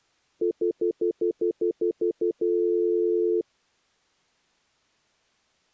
Telephone call progress tone (North American plan), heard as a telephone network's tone, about 350, 440 Hz, 0.1 s on and 0.1 s off. Stutter dial tone.